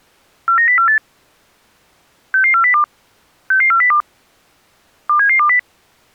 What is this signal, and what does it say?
Five-tone selective call (CCIR), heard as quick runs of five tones, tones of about 100 ms. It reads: 49048 66402 66402 27720